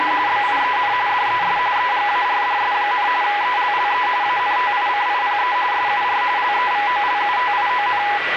RTTY (45.45 baud, 170 Hz shift), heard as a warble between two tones, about 910 Hz centre, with radio static, a steady whistle near 1960 Hz and the noise inside a lift. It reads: … BIEN DES EGARDS, ELLE ANTICIPE SUR LEVOLUTION